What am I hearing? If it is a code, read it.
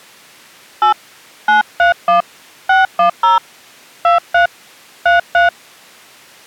DTMF, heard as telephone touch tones, dialled by hand, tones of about 140 ms. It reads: 8 931 610 23 33